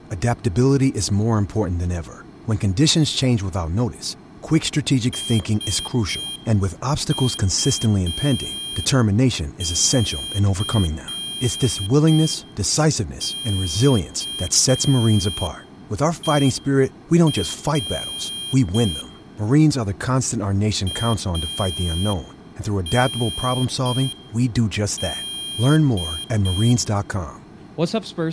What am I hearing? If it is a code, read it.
Morse code, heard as a high beeper, hand-sent with a paddle, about 5 wpm, 3200 Hz, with room echo and speech in English. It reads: SUCKER AND